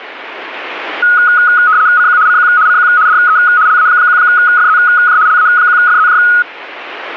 RTTY (75 baud, 170 Hz shift), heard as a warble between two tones, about 1360 Hz centre. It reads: CQ CQ CQ DE LA1FZJ LA1FZJ